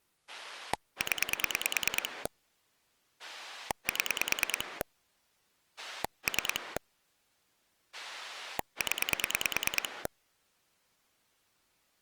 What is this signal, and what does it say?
Pulse dialling, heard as a rotary dial, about 9 pulses a second. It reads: 0 7 3 0